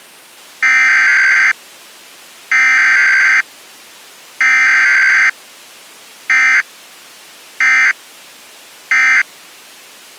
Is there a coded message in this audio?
Yes: Emergency Alert System (SAME) tones (header bursts, then end-of-message bursts) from 0.6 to 9.2 s, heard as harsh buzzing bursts, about 520.83 baud.